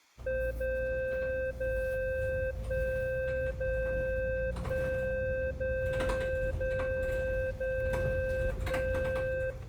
Radio time signal (DCF77), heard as a tone whose level steps once a second, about 520 Hz, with room echo and the noise inside a bus. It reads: 0 0 1 0 1 0 0 0 1